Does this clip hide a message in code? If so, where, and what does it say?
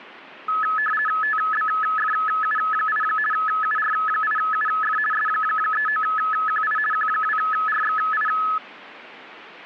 Yes: RTTY (50 baud, 450 Hz shift) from 0.5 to 8.6 s, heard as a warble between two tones, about 1500 Hz centre. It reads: TBFU8 UR8UF S39QI Q2RXI